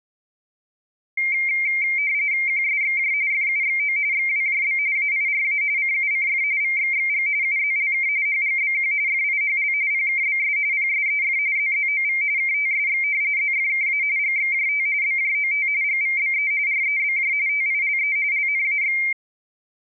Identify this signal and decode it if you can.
RTTY (45.45 baud, 170 Hz shift), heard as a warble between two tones, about 2200 Hz centre. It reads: QSXJ FUXO XWJB AIRA CUCF VXXG UZLK HGBQ FIHL PKBS PSEF ZZOV KTSX ZFKA GXJT BJOT GVBE REBJ TILE LNAX